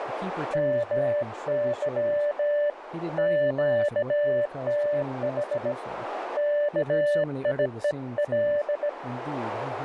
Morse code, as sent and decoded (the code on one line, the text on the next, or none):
-- -.-- / --.- - .... / -.- .. . .-..
MY QTH KIEL